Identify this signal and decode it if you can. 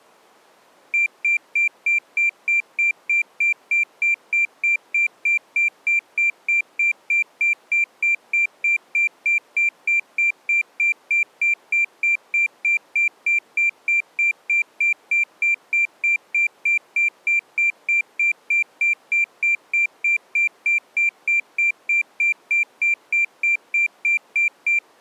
Evenly repeated beeps. There is no code.